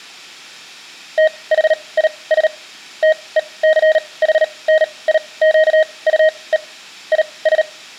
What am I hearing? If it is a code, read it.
Morse code, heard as a keyed tone, machine-sent, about 38 wpm, spaced as for 24 wpm, 630 Hz, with room echo. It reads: THIS TECHNIQUE IS